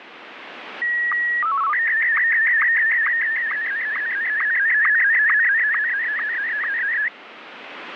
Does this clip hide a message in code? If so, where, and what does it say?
Yes: SSTV (slow-scan television), Martin M1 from 0.8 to 7.1 s, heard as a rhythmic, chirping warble, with radio static.